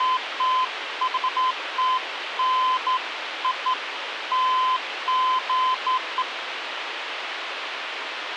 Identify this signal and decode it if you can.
Beeps of irregular length, with radio hiss. There is no code.